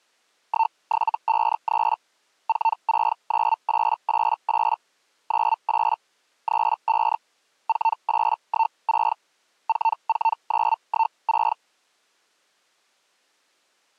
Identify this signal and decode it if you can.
Hellschreiber (Feld-Hell, 122.5 baud), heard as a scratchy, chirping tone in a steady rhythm, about 900 Hz. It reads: 1753 469888 98 35 4816 44916